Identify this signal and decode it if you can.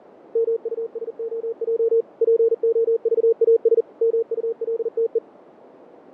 Morse code, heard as a keyed tone, machine-sent, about 40 wpm, 460 Hz, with radio static and fading. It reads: MUSOJ POVAS MULTE